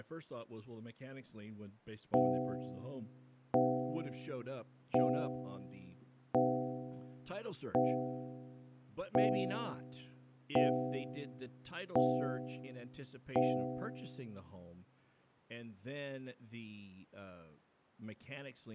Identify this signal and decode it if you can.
Clock strike, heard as a bell, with speech in English. 9. Nine o'clock.